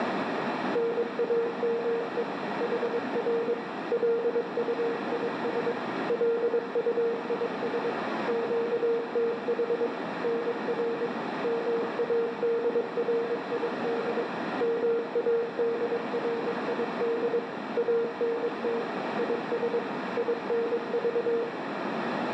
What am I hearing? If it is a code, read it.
Morse code, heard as a keyed tone, machine-sent, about 22 wpm, 460 Hz, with heavy radio static, a narrow filter and room echo. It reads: NAME HR LUIS LUIS QTH NR MADRID MADRID ANT IS INV